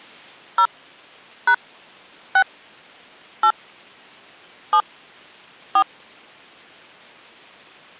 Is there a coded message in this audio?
Yes: DTMF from 0.6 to 5.8 s, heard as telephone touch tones, dialled by hand, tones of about 70 ms. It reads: 0 # 6 8 7 4